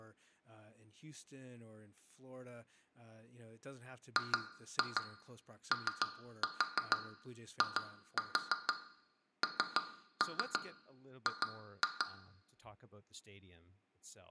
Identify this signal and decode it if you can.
Tap code, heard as taps on glass, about 6 knocks a second, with room echo and speech in English. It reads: GOING